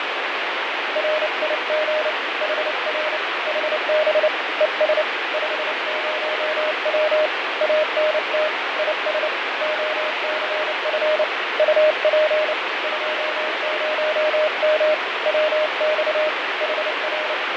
Morse code, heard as a keyed tone, hand-sent with a paddle, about 29 wpm, 620 Hz, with heavy radio static and fading. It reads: RIG HR HB ES 50W ANT IS OCF UP 20M WX HR